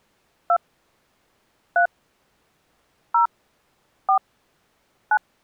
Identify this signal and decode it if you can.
DTMF, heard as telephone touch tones, dialled by hand, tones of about 90 ms. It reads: 2 3 0 4 9